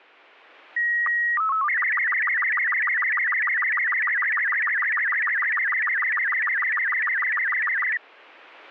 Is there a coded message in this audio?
Yes: SSTV (slow-scan television), Robot 36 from 0.8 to 8.0 s, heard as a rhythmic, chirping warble.